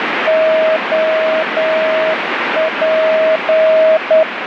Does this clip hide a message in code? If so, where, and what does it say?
Yes: Morse code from 0.2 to 4.3 s, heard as a keyed tone, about 9 wpm, 640 Hz, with heavy radio static. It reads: OP